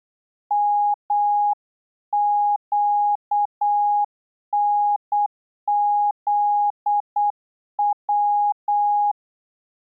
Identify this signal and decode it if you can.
Morse code, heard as a keyed tone, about 8 wpm, 820 Hz. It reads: MQNZW